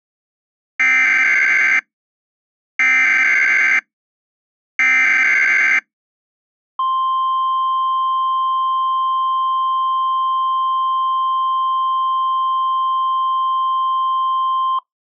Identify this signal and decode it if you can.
Emergency Alert System (SAME) tones (header bursts, then the 1050 Hz attention tone), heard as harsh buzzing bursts, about 520.83 baud.